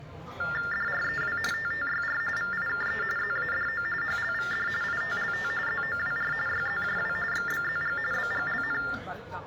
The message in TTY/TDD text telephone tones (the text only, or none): DREW TTYR VIKE ZADO HLVD ITLT ZOWR YZJW XBZG BGLN